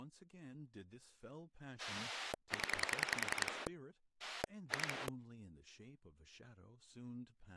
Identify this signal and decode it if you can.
Pulse dialling, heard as a rotary dial, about 10 pulses a second, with speech in English. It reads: 0 2